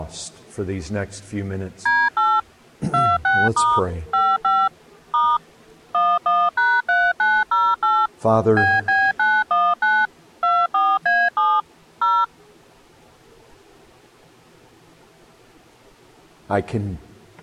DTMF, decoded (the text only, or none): D8 26* 55 * 11#3908 BB919 24A7 0